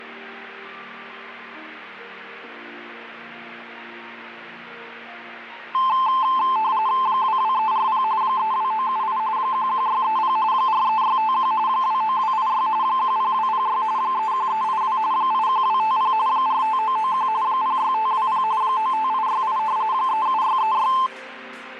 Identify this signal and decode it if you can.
RTTY (45.45 baud, 170 Hz shift), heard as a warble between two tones, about 960 Hz centre. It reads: 22340 32978 11630 43651 29286 10206 31382 81250 45991 06520 95868 37636